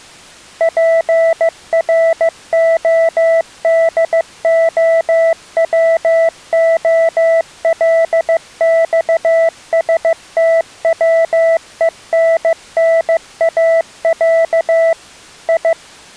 Morse code (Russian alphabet), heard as a keyed tone, machine-sent, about 15 wpm, 660 Hz. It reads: ПРОДОВОЛЬСТВЕННАЯ И